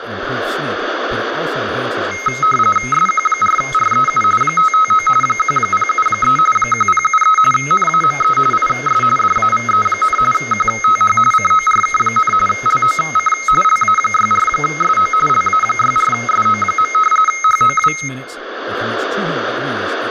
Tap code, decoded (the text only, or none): none